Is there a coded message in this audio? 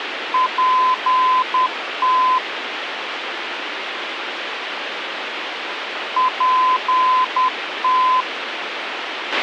Yes: Morse code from 0.3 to 8.3 s, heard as a keyed tone, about 10 wpm, 1020 Hz, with radio hiss and a squelch burst at the end. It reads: PT PT